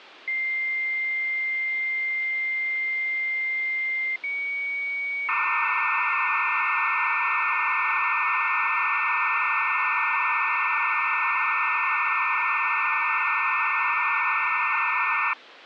Dial-up modem handshake (low-speed, two carriers), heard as two whistles, then hiss, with phone line noise.